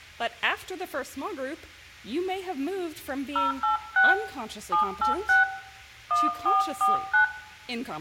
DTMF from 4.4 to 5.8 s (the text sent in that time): 786